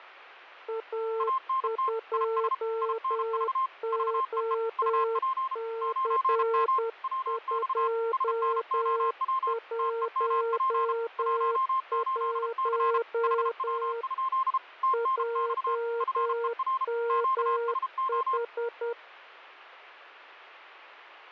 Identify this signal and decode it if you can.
Morse code, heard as two keyed tones. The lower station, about 10 wpm, 460 Hz: A2OC211 JMH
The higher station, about 33 wpm, 1060 Hz: ANT IS INV VEE UP 9M WX SNOW TEMP 18C HW? TNX FER QSO